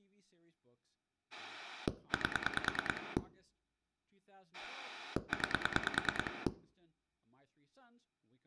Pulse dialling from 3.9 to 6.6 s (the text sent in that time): 9